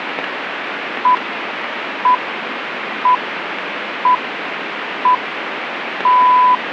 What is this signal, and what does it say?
Radio time signal (six pips, as the Greenwich Time Signal), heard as pips, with radio static.